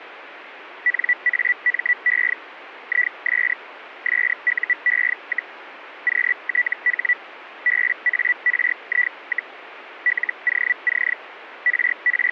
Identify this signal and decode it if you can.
Hellschreiber (Feld-Hell, 122.5 baud), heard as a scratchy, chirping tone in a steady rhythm, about 1950 Hz. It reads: NAME IS SUE, QTH BARI, LOC …